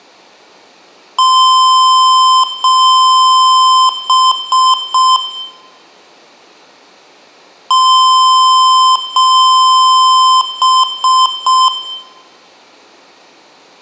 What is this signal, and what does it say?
Beep code, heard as beeps from a small speaker, played twice, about 1030 Hz, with room echo. 2 long, 3 short.